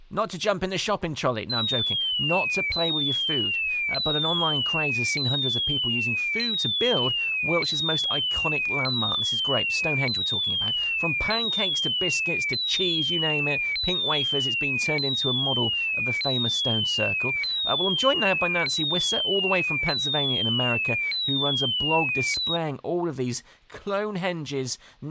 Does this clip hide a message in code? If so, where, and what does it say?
No, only a tone that sweeps in pitch again and again.